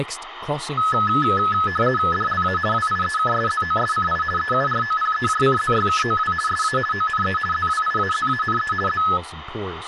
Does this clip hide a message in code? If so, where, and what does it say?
Yes: RTTY (50 baud, 450 Hz shift) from 0.8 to 9.2 s, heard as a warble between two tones, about 1500 Hz centre, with radio static and speech in English. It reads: DLA WIEKSZOSCI EUROPEJCZYKOW SA ONE ZWIAZANE Z